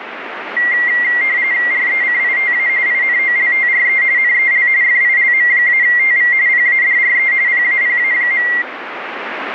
RTTY (45.45 baud, 170 Hz shift), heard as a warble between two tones, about 2000 Hz centre, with radio static. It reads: RECITA INOLTRE NEL FILM-TV PADRE PAPA.